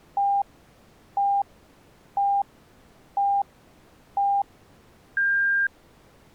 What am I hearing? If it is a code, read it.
Radio time signal (five pips and a higher one, as on Chinese radio), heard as pips.